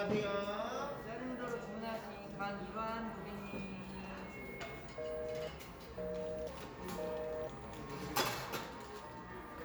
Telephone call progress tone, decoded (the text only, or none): busy tone